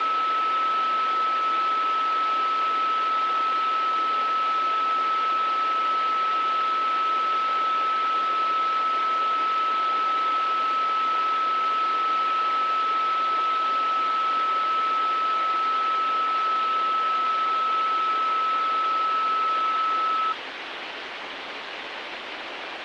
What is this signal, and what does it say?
A steady tone, with phone line noise. There is no code.